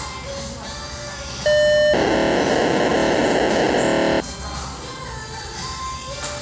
POCSAG pager data (1200 baud), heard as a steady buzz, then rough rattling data, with the noise of a restaurant.